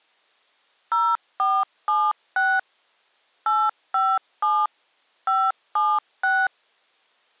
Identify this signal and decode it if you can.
DTMF, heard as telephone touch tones, dialled by machine, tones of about 230 ms. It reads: 0476 857 576